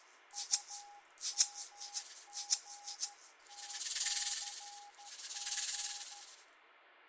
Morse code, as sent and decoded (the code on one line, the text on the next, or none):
..- -- --. - -.-. --.
UMGTCG